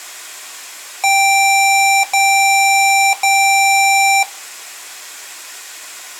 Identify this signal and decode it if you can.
Beep code, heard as beeps from a small speaker, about 780 Hz. 3 long. In IBM BIOS tables: keyboard card error.